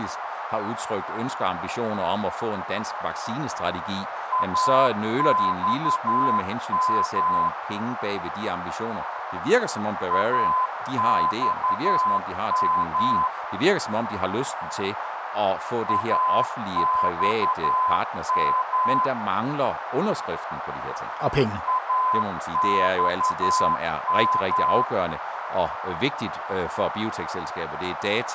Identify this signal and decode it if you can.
Morse code, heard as a keyed tone, machine-sent, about 11 wpm, 1020 Hz, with radio static, a narrow filter and speech in Danish. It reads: AXM AXM AXM AXM